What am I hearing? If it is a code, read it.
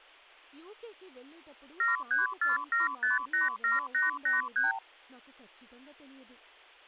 Multi-frequency trunk signalling (R2, with the far end's replies), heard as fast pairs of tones, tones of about 150 ms, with speech in Telugu. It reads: 7347587883